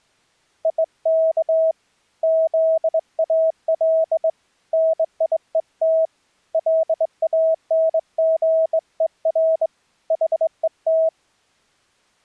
Morse code, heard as a keyed tone, hand-sent with a straight key, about 21 wpm, 650 Hz. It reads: IK ZAL NIET LANGER HET